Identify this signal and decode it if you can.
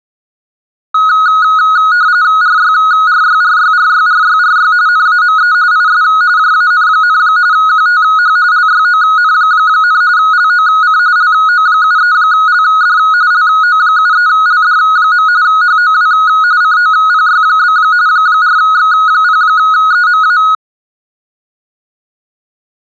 RTTY (45.45 baud, 170 Hz shift), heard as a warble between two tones, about 1360 Hz centre. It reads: RYRYRYRYRYRY NAME IS JAN, QTH LYON, LOC LO73LD LO73LD. HOW COPY? 4X0EMA